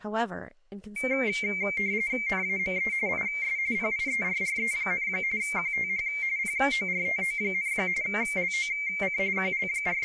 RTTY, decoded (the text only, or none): NAME IS PIERRE, QTH PORTO, LOC …